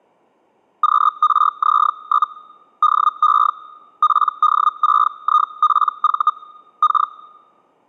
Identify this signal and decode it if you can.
Hellschreiber (Feld-Hell, 122.5 baud), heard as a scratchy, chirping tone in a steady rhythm, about 1230 Hz. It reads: QRZ? DE PD6IPV K